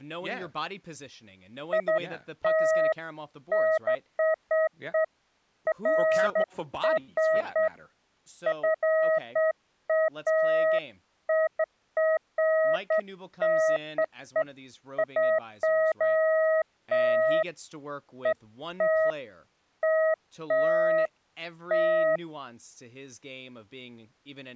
Beeps of irregular length, with speech in English. There is no code.